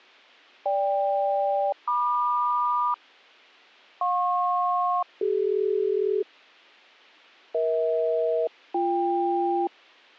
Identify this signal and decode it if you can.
Aircraft SELCAL, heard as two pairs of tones. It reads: GK-MQ JP-CD EH-BK